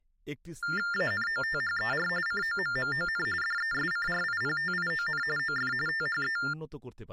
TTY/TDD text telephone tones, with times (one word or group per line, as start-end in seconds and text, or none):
0.9-2.1 ANOTHER
2.3-3.3 COMMON
3.4-5.2 DESCRIPTION
5.4-5.7 OF
5.9-6.4 THE